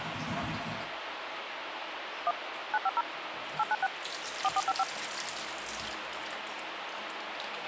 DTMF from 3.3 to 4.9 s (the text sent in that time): 896 4455